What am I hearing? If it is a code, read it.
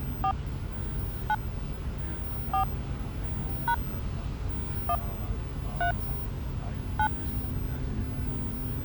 DTMF, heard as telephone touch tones, dialled by hand, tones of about 80 ms, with the noise inside a bus. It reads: 4 9 4 # 1 3 9